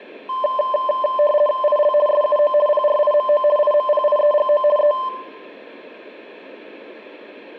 RTTY (50 baud, 450 Hz shift), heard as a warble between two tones, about 820 Hz centre, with room echo. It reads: IL SUO PRIMO IMPIEGO E